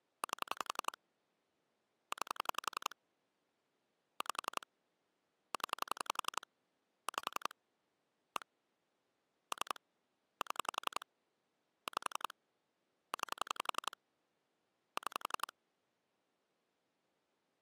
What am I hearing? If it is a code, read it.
Pulse dialling, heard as clicks on a phone line, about 11 pulses a second. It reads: 8 9 5 0 5 1 3 7 5 9 6